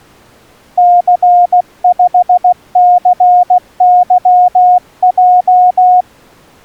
Morse code, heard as a keyed tone, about 16 wpm, 720 Hz. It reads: C5CYJ